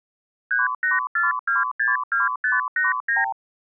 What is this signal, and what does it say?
Multi-frequency trunk signalling (R2, with the far end's replies), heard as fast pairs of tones, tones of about 160 ms. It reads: 384262589